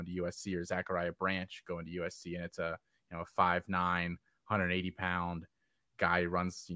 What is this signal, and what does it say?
Speech in English. There is no code.